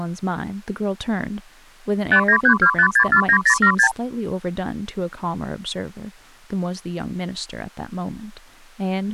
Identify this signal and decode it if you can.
Multi-frequency trunk signalling (R2, with the far end's replies), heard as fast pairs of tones, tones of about 80 ms, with speech in English. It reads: 59325649076